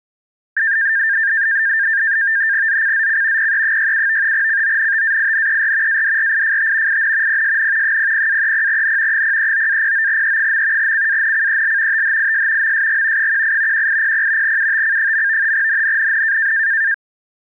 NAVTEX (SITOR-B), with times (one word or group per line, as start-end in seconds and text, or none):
2.7-3.5 ZCZC
3.4-4.3 PE67
4.3-6.0 CONTAINER
5.9-7.0 ADRIFT
6.9-7.4 IN
7.3-8.0 PSN
7.8-9.2 00-30N
9.1-10.9 039-09E.
10.8-12.0 CANCEL
11.9-12.7 THIS
12.6-13.3 MSG
13.2-13.9 18
13.7-14.6 1800
14.4-15.5 UTC.
15.5-16.5 NNNN